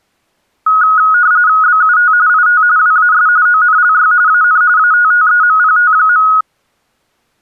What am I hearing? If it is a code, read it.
RTTY (45.45 baud, 170 Hz shift), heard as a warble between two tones, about 1360 Hz centre. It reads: BUT IT WAS ONLY AN ATTEMPT.